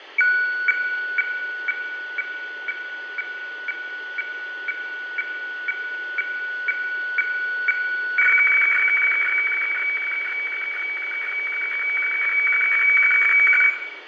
Weather fax (radiofax), 120 lines a minute, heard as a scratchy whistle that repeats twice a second, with radio static, fading and room echo.